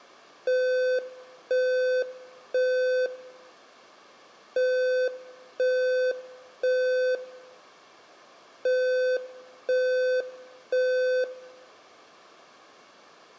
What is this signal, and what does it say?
Alarm pattern, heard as an alarm's beeps, played three times, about 510 Hz, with room echo. Temporal three. Smoke or fire, evacuate.